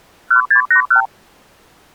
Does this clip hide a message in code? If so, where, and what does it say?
Yes: multi-frequency trunk signalling (R2, with the far end's replies) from 0.3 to 1.1 s, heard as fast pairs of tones, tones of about 100 ms. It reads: 1681